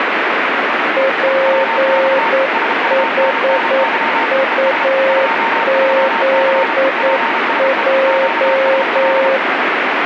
Morse code, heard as two keyed tones, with radio static. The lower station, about 9 wpm, 540 Hz: PHUZJ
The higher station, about 33 wpm, 910 Hz: WX SUNNY ES 23C PSE QSL